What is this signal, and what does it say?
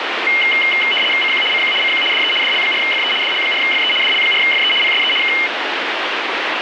RTTY (75 baud, 850 Hz shift), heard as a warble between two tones, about 2550 Hz centre, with radio static. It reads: CQ CQ CQ DE DL4FE DL4FE DL4FE PSE K